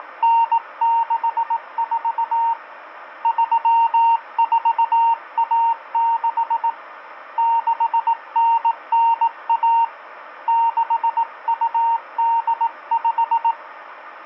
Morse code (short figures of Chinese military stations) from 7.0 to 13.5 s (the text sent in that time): 6991 6285